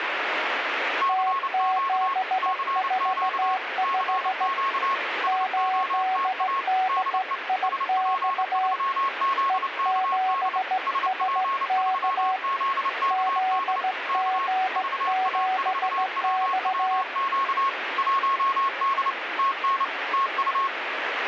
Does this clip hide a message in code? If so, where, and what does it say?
Yes: Morse code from 1.0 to 20.7 s, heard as two keyed tones, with radio static. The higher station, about 29 wpm, 1090 Hz: CQ CQ CQ SOTA DE SP3ZKD SP3ZKD K VA4WWQ 1D TN TU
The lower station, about 16 wpm, 750 Hz: T745 8DIX E7SK ZG7X